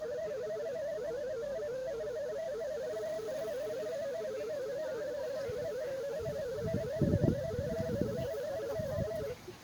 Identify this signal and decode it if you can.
Multi-tone FSK (Olivia or MFSK type), about 250 Hz wide, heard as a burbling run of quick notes, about 31.25 baud, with the noise of a park.